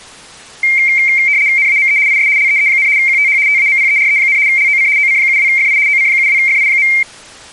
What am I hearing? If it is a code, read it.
RTTY (75 baud, 170 Hz shift), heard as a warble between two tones, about 2200 Hz centre. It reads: NAME IS LEE, QTH TAMPERE, LOC OC72FI OC72FI.